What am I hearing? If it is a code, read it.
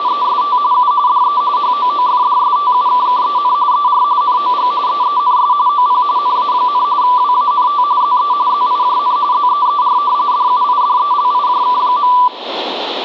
RTTY (45.45 baud, 170 Hz shift), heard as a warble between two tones, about 1080 Hz centre, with radio static. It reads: … U DE HOOFDSTUKKEN ER NOG EENS OP NA, WANT ZE ZIJN ZEER DUIDELIJK.